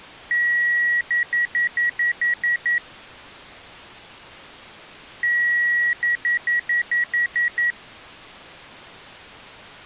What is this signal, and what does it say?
Beep code, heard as beeps from a small speaker, played twice, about 1900 Hz. 1 long, 8 short. In AMI BIOS tables: display or retrace test failure.